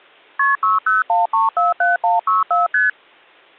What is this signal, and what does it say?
Multi-frequency trunk signalling (R1, as on North American trunks), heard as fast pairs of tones, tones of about 160 ms. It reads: KP 601347164 ST